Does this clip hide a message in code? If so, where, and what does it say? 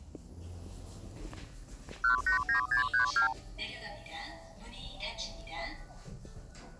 Yes: multi-frequency trunk signalling (R2, with the far end's replies) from 2.0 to 3.3 s, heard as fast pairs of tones, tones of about 110 ms, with the noise inside a lift. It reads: 189632